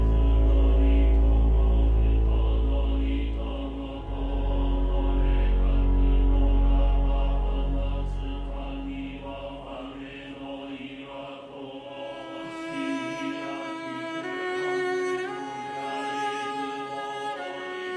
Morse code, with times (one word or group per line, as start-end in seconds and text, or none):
none